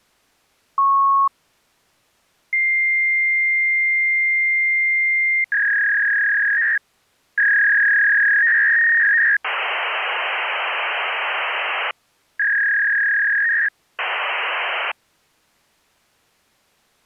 Fax machine handshake, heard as a beep, a long tone, a warble and hiss.